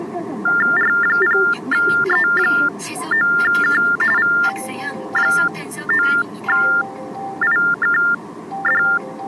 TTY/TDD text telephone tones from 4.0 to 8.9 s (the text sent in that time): V9IKD